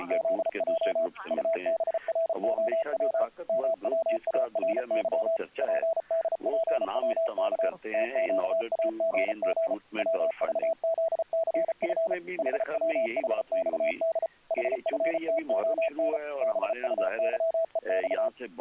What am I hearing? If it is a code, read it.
Morse code, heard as a keyed tone, machine-sent, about 34 wpm, 660 Hz. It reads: … UBROW MWARY PDPWK TQAGG WVZCF HWHXD HFTON BUYEX